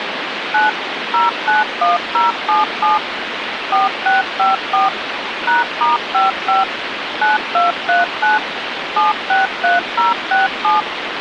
DTMF, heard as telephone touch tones, dialled by machine, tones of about 160 ms, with phone line noise. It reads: 9 091077 4654 #*55 9239 763067